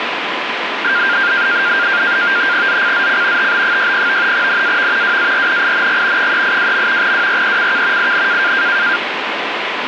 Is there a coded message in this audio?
Yes: NAVTEX (SITOR-B), 100 baud, 170 Hz shift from 0.8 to 9.0 s, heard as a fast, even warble, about 1500 Hz centre, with radio static. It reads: ZCZC TB60 NAV WARNING 382. WRECK IN